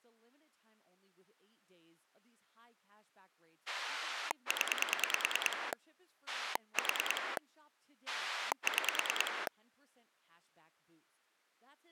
Pulse dialling, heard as a rotary dial, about 9 pulses a second, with speech in English. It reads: 0 4 6